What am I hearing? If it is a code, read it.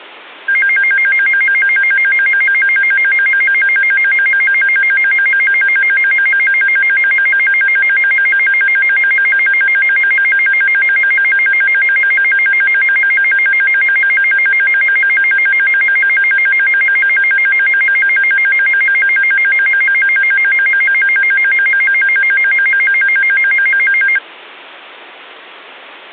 A tone that alternates evenly between two pitches. There is no code.